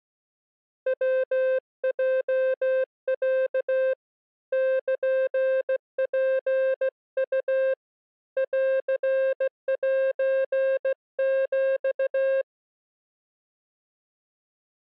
Morse code (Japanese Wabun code), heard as a keyed tone, hand-sent with a straight key, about 16 wpm, 530 Hz. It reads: ヤヲロ ルツウ ンセヒ